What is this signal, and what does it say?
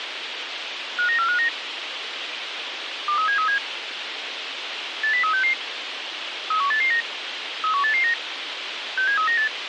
Five-tone selective call (CCIR), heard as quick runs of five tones, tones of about 100 ms, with radio hiss. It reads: 59459 23737 80366 31889 31889 67398